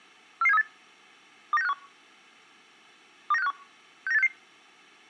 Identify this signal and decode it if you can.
Five-tone selective call (EEA), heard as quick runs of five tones, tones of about 40 ms. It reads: 44738 29651 29651 69866